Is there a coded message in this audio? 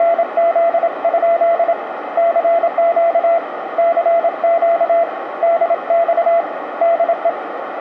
Yes: Morse code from 0.0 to 7.4 s, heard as a keyed tone, hand-sent with a paddle, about 27 wpm, 680 Hz, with radio static, a narrow filter and room echo. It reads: … CQ CQ DX DE